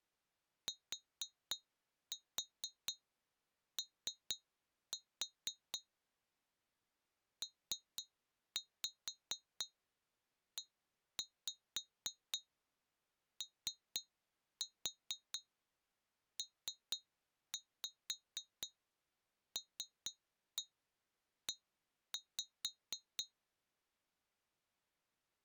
Tap code, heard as taps on glass, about 4 knocks a second. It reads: TO PEOPLE